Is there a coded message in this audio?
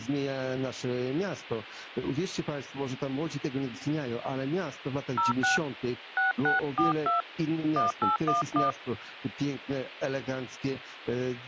Yes: DTMF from 5.2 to 8.7 s, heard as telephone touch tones, dialled by hand, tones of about 140 ms. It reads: 06 6642 1811